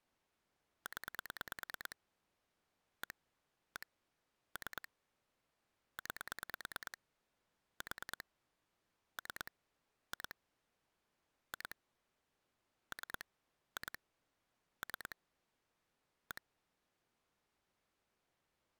Pulse dialling, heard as clicks on a phone line, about 9 pulses a second. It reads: 0 1 1 3 9 4 3 2 2 3 2 3 1